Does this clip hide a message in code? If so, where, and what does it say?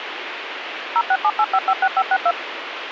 Yes: DTMF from 1.0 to 2.3 s, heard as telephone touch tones, dialled by machine, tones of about 60 ms, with radio hiss. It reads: 0678556562